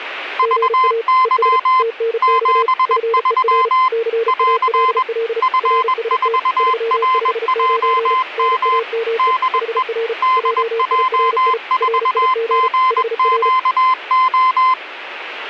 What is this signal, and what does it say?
Morse code, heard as two keyed tones, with radio static. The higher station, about 21 wpm, 1030 Hz: VY 73 <AR> F4RJM DE DJ4GQO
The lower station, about 35 wpm, 460 Hz: GA ES TNX FER CALL RST 359 NAME HR JIRI RIG HR